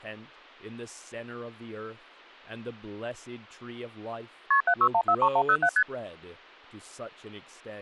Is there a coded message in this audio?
Yes: multi-frequency trunk signalling (R1, as on North American trunks) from 4.5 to 5.8 s, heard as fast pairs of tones, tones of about 70 ms, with speech in English. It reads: KP 76143107 ST